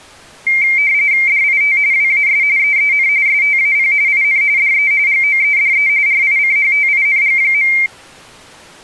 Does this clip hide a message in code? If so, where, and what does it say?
Yes: RTTY (45.45 baud, 170 Hz shift) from 0.5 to 7.9 s, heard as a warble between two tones, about 2200 Hz centre. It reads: DIT WAS EEN STAP IN DE GOEDE RICHTING.